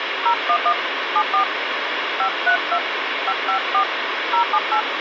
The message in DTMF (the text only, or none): 011 74 532 554 078